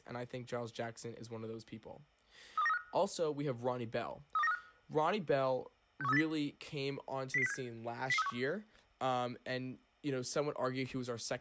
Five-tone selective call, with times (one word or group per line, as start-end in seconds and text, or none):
2.6-2.8 32935
4.4-4.6 32935
6.0-6.2 61380
7.3-7.5 00067
8.1-8.3 00361